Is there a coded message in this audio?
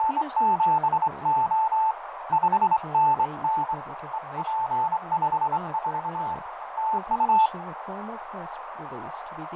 Yes: Morse code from 0.0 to 7.5 s, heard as a keyed tone, hand-sent with a straight key, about 24 wpm, 880 Hz, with heavy radio static, fading, a narrow filter and speech in English. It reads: … 5NN EP54 TU